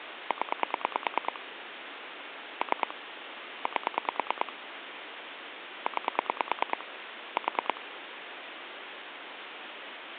Pulse dialling, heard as clicks on a phone line, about 9 pulses a second, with phone line noise. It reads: 0 3 8 9 4